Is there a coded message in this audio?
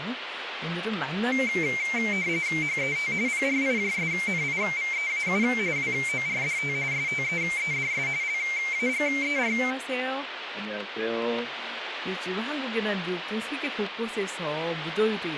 Yes: RTTY (45.45 baud, 170 Hz shift) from 1.3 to 9.7 s, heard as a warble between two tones, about 2200 Hz centre, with radio static and speech in Korean. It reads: HET PRIJSNIVEAU WORDT STEEDS LAGER